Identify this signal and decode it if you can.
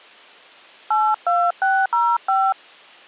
DTMF, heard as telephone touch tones, dialled by hand, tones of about 240 ms. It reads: 82605